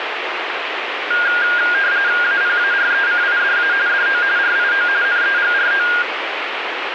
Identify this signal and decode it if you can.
RTTY (45.45 baud, 170 Hz shift), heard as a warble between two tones, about 1500 Hz centre, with radio static. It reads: APARECIDA DO RIO NEGRO